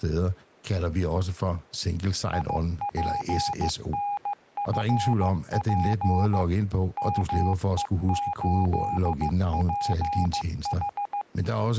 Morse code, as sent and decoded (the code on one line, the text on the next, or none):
.. .--. -. ..-. .--. / -- . ---.. .--. ....
IPNFP ME8PH